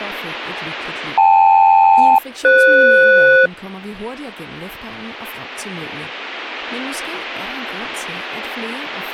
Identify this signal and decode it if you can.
Aircraft SELCAL, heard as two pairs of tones, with speech in Danish. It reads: KL-FS